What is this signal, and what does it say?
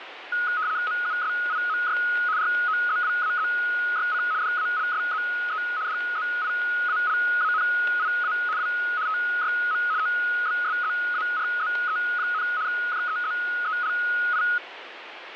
RTTY (75 baud, 170 Hz shift), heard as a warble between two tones, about 1360 Hz centre, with radio static and static crashes. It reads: MUSIMY ROZWAZYC DALSZE DZIALANIA W TYM OBSZARZE, JEZELI